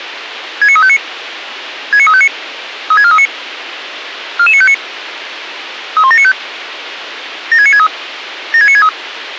Five-tone selective call (ZVEI), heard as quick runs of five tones, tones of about 70 ms, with radio hiss. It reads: 69359 69359 36439 44959 31795 76963 76963